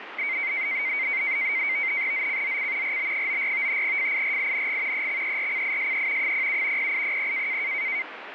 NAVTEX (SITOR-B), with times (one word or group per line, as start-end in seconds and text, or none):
2.1-3.0 ZCZC
2.8-3.8 RB94
3.8-5.1 FIRING
4.9-6.3 EXERCISE
6.2-6.9 07
6.8-7.6 0800